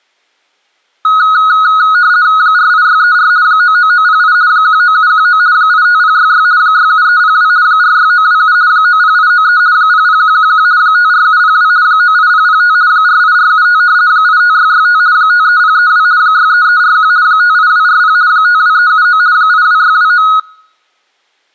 RTTY (50 baud, 170 Hz shift), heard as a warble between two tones, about 1360 Hz centre. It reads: 48634 99908 19719 85066 67302 46927 90893 00111 54702 98005 48475 85665 53032 63341 58240 52379 82629